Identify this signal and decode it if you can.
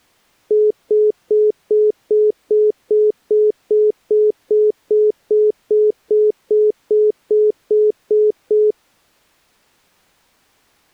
Telephone call progress tone (single-tone plan, as in most of Europe), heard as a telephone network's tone, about 420 Hz, 0.2 s on and 0.2 s off. Congestion tone.